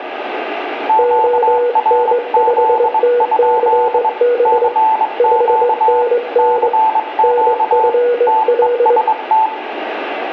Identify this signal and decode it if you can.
Morse code, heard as two keyed tones, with radio static and room echo. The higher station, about 22 wpm, 880 Hz: QRZ? CQ CQ TEST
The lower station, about 21 wpm, 480 Hz: ON5TCB 5NN NFL